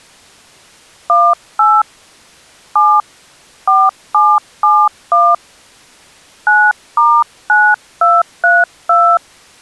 DTMF, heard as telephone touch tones, dialled by hand, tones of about 240 ms. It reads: 18 7 4771 9*9232